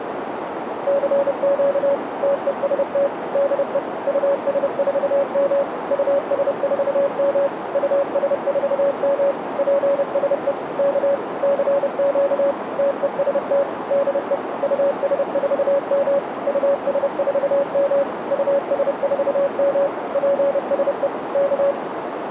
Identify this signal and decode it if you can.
Morse code, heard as a keyed tone, machine-sent, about 30 wpm, 560 Hz, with radio static and a narrow filter. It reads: CQ TEST DE US4M US4M US4M PSE K CQ TEST DE US4M US4M US4M PSE K